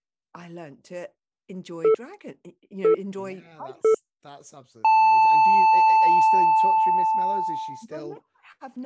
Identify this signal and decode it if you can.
Radio time signal (three low pips and a long one an octave up, as on NHK), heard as pips, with speech in English.